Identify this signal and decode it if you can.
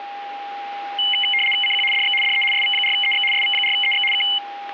RTTY (75 baud, 850 Hz shift), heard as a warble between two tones, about 2550 Hz centre, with a steady whistle near 810 Hz. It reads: CQ DX DE SV4EX SV4EX K